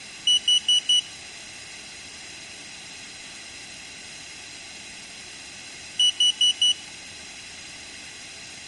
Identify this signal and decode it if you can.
Alarm pattern, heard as an alarm's beeps, played twice, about 2950 Hz. Temporal four. Carbon monoxide.